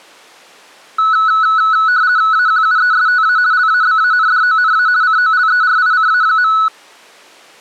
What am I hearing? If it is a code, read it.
RTTY (50 baud, 170 Hz shift), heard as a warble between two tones, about 1390 Hz centre. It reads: AQUESTA LABANDONA COLERICA.